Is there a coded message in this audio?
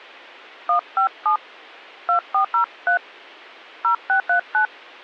Yes: DTMF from 0.7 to 4.7 s, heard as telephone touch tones, dialled by hand, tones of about 100 ms. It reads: 157 2403 0639